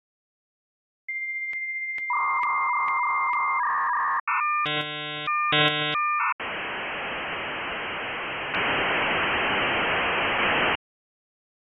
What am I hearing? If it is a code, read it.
Dial-up modem handshake (V.34 or later), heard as a whistle, warbles, then hiss.